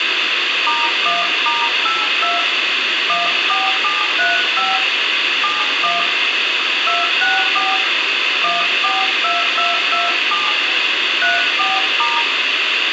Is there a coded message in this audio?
Yes: DTMF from 0.7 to 12.2 s, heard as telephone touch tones, dialled by hand, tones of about 170 ms, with radio hiss and room echo. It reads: *1*82 14735 71 264 142227 34*